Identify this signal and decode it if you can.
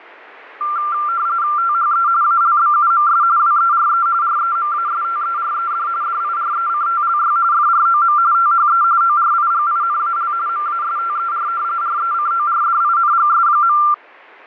RTTY (45.45 baud, 170 Hz shift), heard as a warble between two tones, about 1280 Hz centre. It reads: THE ALBUMS WERE REMASTERED DIRECTLY FROM THE ORIGINAL MASTER RECORDINGS.